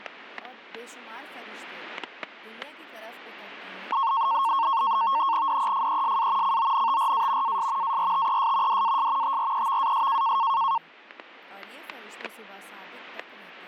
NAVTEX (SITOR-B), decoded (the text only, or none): DEFESA CONTRA AS ARTES DAS TREVAS